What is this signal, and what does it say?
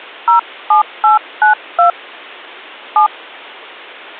DTMF, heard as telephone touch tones, dialled by hand, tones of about 120 ms. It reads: 07892 7